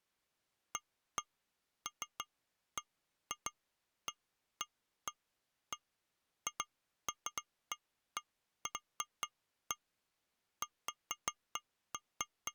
Irregular taps on glass. There is no code.